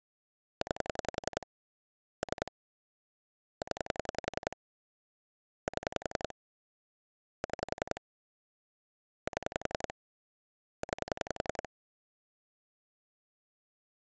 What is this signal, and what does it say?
Pulse dialling, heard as clicks on a phone line, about 11 pulses a second. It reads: 9 3 0 7 6 7 9